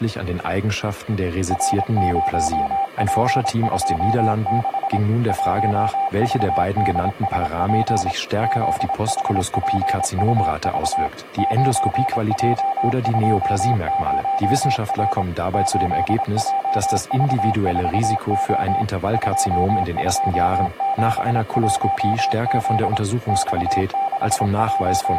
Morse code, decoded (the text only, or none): R0P26 1VDSP ZHPUV 9J20R 8JV4O 2271Z …